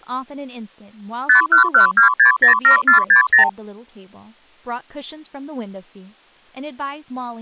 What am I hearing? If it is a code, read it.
Multi-frequency trunk signalling (R2, with the far end's replies), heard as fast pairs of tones, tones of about 110 ms, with speech in English. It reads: 5112607460